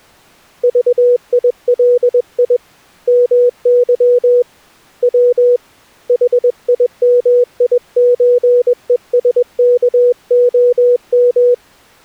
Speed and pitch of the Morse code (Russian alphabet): 21 wpm, 490 Hz

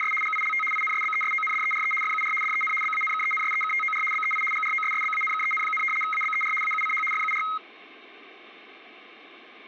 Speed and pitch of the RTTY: 75 baud, 850 Hz shift, 1700 Hz centre

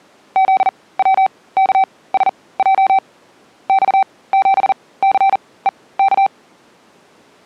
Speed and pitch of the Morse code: 40 wpm, spaced as for 21 wpm, 770 Hz

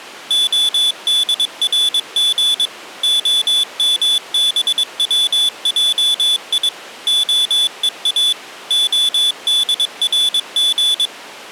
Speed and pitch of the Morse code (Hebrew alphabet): 22 wpm, 3450 Hz

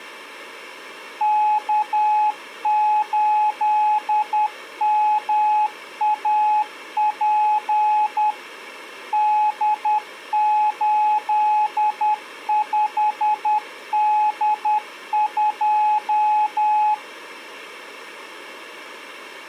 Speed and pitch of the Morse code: 10 wpm, 850 Hz

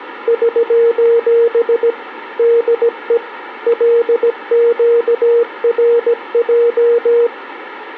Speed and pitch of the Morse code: 17 wpm, 470 Hz

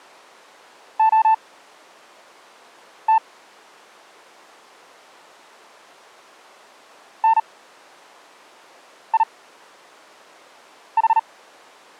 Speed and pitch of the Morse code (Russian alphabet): 38 wpm, spaced as for 5 wpm, 900 Hz

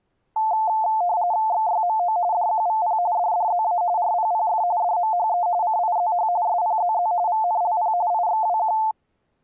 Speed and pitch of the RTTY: 45.45 baud, 170 Hz shift, 790 Hz centre

